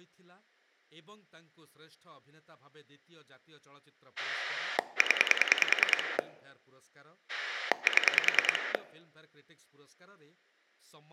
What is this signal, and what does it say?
Pulse dialling, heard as a rotary dial, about 10 pulses a second, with speech in Odia. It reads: 0 7